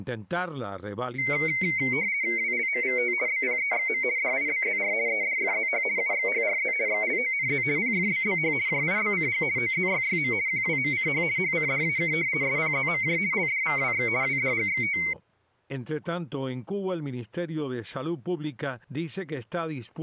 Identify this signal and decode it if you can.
RTTY (50 baud, 170 Hz shift), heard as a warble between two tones, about 2150 Hz centre. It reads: WLMVT BPEXM DIBZR EDFZH UXHRZ XLONZ PFBBH JIBCG OZYYM QWMCH HCDAK SPZMJ LDVWX WDGXT